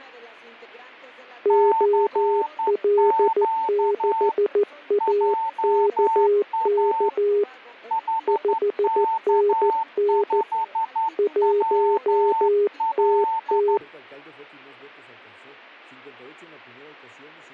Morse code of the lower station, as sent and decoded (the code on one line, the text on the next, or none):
--- .-.. -.... .- -.- -.- / ..... -. -. / .---- - -
OL6AKK 5NN 1TT